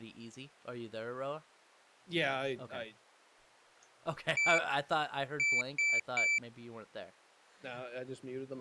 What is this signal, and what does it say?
Beep code, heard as a piezo beeper, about 2300 Hz, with speech in English. 1-3.